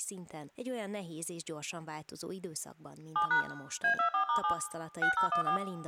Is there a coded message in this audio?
Yes: DTMF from 3.2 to 5.6 s, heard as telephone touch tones, dialled by machine, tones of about 100 ms, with room echo and speech in Hungarian. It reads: 7# A24*7 6014